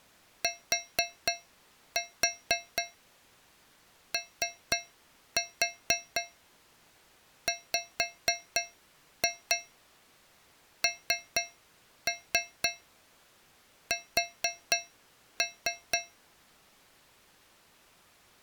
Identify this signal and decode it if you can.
Tap code, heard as taps on a metal pipe, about 4 knocks a second. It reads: TOWNS